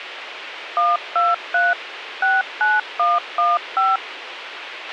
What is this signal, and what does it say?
DTMF, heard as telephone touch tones, dialled by machine, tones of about 190 ms, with radio hiss and a squelch burst at the end. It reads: 123 69115